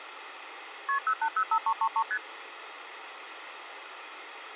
Multi-frequency trunk signalling (R1, as on North American trunks), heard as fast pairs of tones, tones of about 70 ms, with phone line noise. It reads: KP 0805333 ST